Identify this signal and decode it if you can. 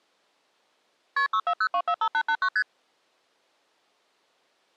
Multi-frequency trunk signalling (R1, as on North American trunks), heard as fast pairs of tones, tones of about 70 ms. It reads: KP 640245889 ST